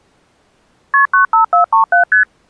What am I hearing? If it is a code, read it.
Multi-frequency trunk signalling (R1, as on North American trunks), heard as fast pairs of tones, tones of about 120 ms. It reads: KP 95437 ST